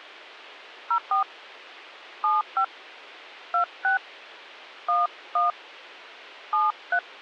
DTMF, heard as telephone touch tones, dialled by hand, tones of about 120 ms. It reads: 04 75 26 11 73